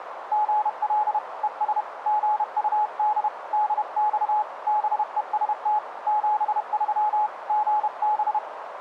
Morse code, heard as a keyed tone, hand-sent with a paddle, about 31 wpm, 850 Hz, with radio static and a narrow filter. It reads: GL ES GUD DX BEST 73 GB